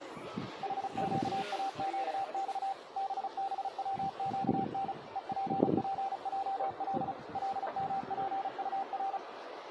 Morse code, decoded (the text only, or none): HQAQX BBWQN EPPJL LMPUR